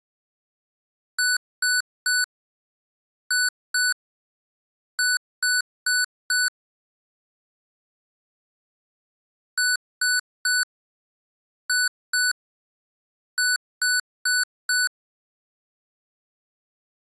Beep code, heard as beeps from a small speaker, played twice, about 1490 Hz. 3-2-4. In Phoenix BIOS tables: keyboard controller failure.